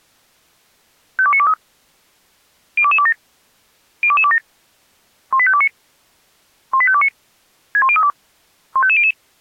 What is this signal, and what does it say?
Five-tone selective call (ZVEI), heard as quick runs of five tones, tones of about 70 ms. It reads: 52923 02227 02227 18529 18529 61032 15500